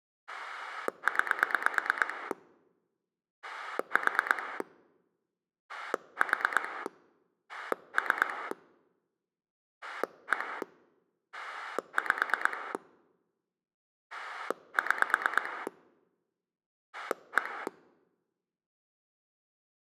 Pulse dialling, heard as a rotary dial, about 8 pulses a second. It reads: 9 4 4 3 1 5 6 1